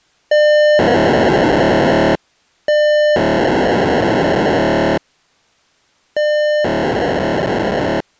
POCSAG pager data (1200 baud), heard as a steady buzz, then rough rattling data.